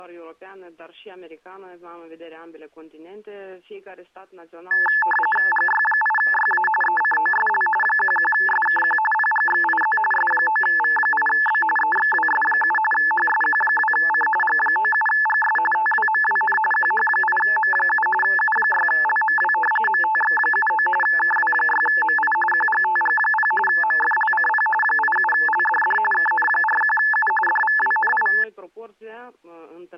RTTY (45.45 baud, 850 Hz shift), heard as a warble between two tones, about 1300 Hz centre. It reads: GY8YA ECOSL 11SKQ PGXIZ S9V8B EXWS7 HSQ2C G97GS TWMWN QH8M7 U6LMW MTX79 KW6MI QGTG0 MFLCP 87LDD KN41U DVWNI